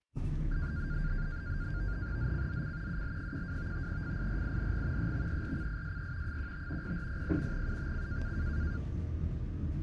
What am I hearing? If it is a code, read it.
NAVTEX (SITOR-B), 100 baud, 170 Hz shift, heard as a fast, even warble, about 1500 Hz centre, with the noise inside a bus. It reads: ZCZC UL12 FIRING EXERCISE 15 0400 UTC